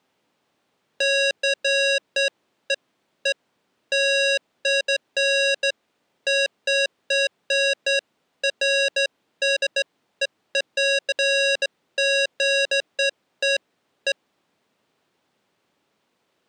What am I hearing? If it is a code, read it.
Beeps of irregular length. There is no code.